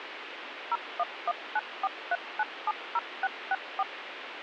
DTMF, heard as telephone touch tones, dialled by machine, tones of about 40 ms, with radio hiss. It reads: 011943970664